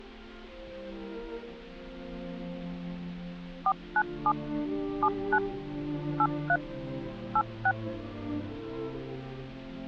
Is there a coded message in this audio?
Yes: DTMF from 3.7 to 7.7 s, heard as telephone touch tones, dialled by machine, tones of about 60 ms. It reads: 497 79 83 86